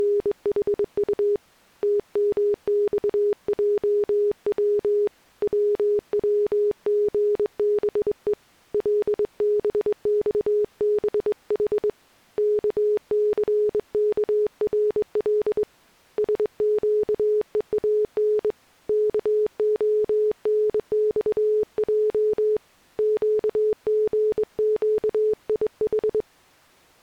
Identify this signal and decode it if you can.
Morse code, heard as a keyed tone, hand-sent with a straight key, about 22 wpm, 420 Hz. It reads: … TMXJW WWGBE LBXBH KCKRL SQEAN KONXJ QGQIH